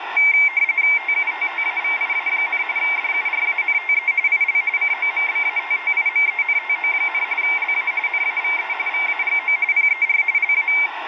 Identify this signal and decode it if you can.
RTTY (45.45 baud, 170 Hz shift), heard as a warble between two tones, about 2200 Hz centre, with radio static. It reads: TUTTAVIA, DURANTE IL COMBATTIMENTO, LA NAVE VAGO PER LA